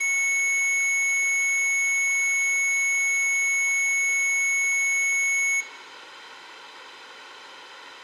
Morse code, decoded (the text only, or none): none